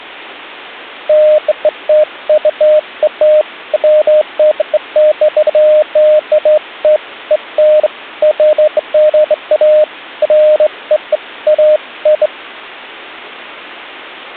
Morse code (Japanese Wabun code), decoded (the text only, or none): none